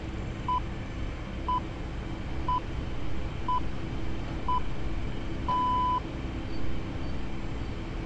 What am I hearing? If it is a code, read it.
Radio time signal (six pips, as the Greenwich Time Signal), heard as pips, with street noise.